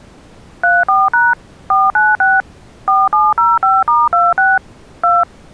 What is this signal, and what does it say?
DTMF, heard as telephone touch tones, dialled by machine, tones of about 200 ms. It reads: 34# 496 4705*26 2